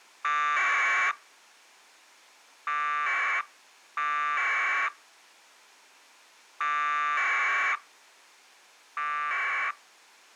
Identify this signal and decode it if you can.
Packet radio (AX.25, as in APRS), 1200 baud, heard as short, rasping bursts.